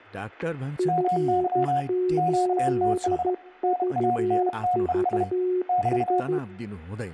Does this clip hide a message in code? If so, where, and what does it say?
Yes: Morse code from 0.7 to 6.4 s, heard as two keyed tones, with static crashes and speech in Nepali. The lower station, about 13 wpm, 360 Hz: F8VVS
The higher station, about 32 wpm, 720 Hz: MY QTH NANTES <BT>